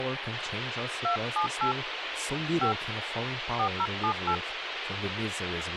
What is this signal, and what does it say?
DTMF, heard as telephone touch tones, dialled by hand, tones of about 80 ms, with radio hiss and speech in English. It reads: 278 5 4078